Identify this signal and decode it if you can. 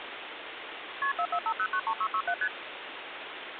Multi-frequency trunk signalling (R1, as on North American trunks), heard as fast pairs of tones, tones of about 70 ms, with phone line noise. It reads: KP 445093667 ST